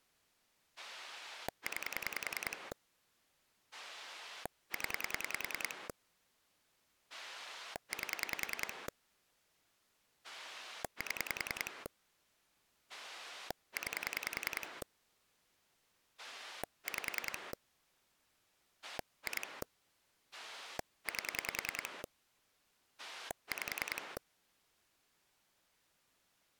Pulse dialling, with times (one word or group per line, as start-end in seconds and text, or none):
0.8-2.7 9
3.7-5.9 0
7.1-8.9 8
10.2-11.9 7
12.9-14.8 9
16.2-17.5 5
18.8-19.6 2
20.3-22.0 8
23.0-24.2 5